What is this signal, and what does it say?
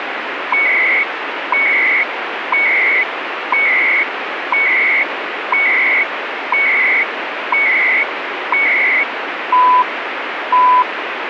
Radio time signal (CHU, Canada), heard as beeps and data bursts, one a second, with radio static.